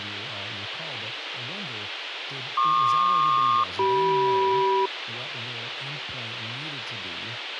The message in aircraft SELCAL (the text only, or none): PQ-CM